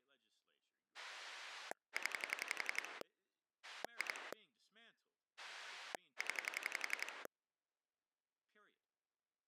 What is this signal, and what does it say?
Pulse dialling, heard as a rotary dial, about 11 pulses a second, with speech in English. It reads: 0 2 0